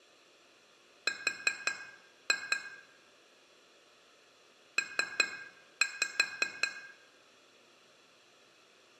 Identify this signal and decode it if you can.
Tap code, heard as taps on glass, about 5 knocks a second, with room echo. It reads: R P